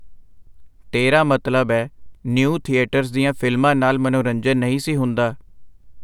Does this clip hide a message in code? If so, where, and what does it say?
No, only speech in Punjabi.